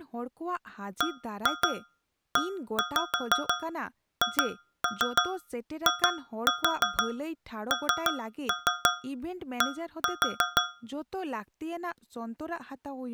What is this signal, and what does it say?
Tap code, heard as taps on a metal pipe, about 6 knocks a second, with speech in Santali. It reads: BEHIND